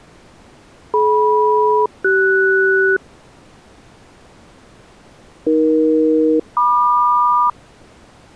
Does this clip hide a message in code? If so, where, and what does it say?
Yes: aircraft SELCAL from 0.9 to 7.5 s, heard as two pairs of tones. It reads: DM-CS AE-MQ